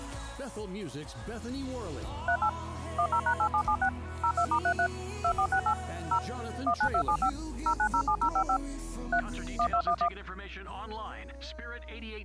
DTMF, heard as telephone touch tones, dialled by machine, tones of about 80 ms. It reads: 38 10#8776 02*33 2468 0 19275 0907055 3 1211